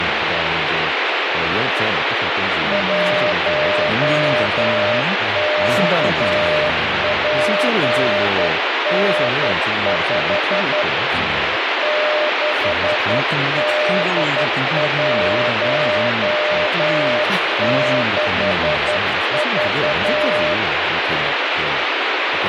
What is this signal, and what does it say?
Morse code, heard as a keyed tone, hand-sent with a straight key, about 11 wpm, 600 Hz, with heavy radio static and speech in Korean. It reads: 1KPN5 6D16V